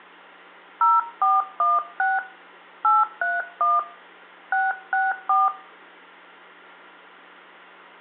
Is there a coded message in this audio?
Yes: DTMF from 0.8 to 5.5 s, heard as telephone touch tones, dialled by hand, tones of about 190 ms, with hum and room echo. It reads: 0416 831 664